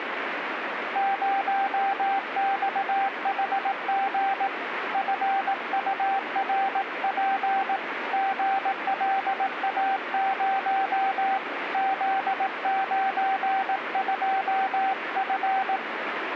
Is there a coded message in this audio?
Yes: Morse code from 0.9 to 15.8 s, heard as a keyed tone, hand-sent with a paddle, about 18 wpm, 780 Hz, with radio static. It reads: 0XHG FURP GLA0 Z92F